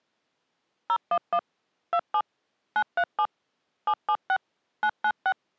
DTMF, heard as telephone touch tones, dialled by machine, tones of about 60 ms. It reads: 011 27 937 776 996